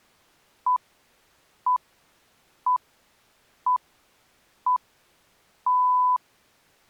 Radio time signal (six pips, as the Greenwich Time Signal), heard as pips.